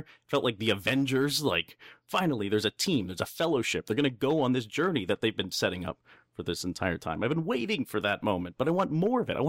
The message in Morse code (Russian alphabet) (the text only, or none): none